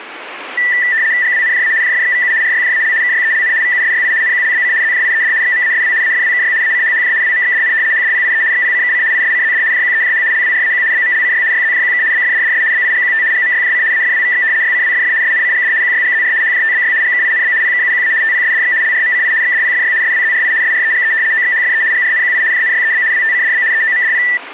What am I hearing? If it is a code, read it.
RTTY (75 baud, 170 Hz shift), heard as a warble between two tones, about 1850 Hz centre. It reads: GWNJA JFXVU RYJAL KYELN VUSYI NQLBC ZJIED XMASW AFWKY ACHHJ WMXDN HDPIE XPCKC ISCZD JQEJH LWRAQ BMLCY YZJQK BFDDS BIGQT GMYJC AFWVX YCWFF SNCGD QYGZR HJTBY GKINB PKUQA TPSDX LRMCI XDPFY SWZRI SREGE OXHFE GRNQI JNYEB WTCDB EOMDP